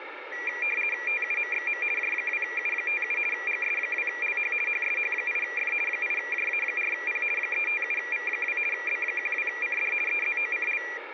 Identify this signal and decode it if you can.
RTTY (50 baud, 450 Hz shift), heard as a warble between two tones, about 2150 Hz centre, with radio static. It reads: TUMXM J2U57 GS2LH HSH8F 8JA4P 357V2 B12CD EZOCL